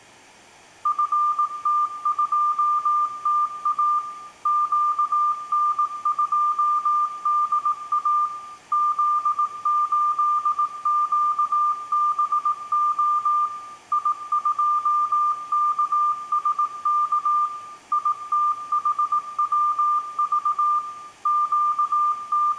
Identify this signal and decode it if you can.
Morse code, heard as a keyed tone, machine-sent, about 18 wpm, 1200 Hz, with room echo. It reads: FT2TA QN2DA Z8QBO I2KSK ITHWV …